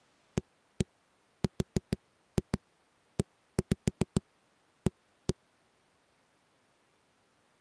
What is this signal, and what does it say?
Tap code, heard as knocks on a wall, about 7 knocks a second. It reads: AREA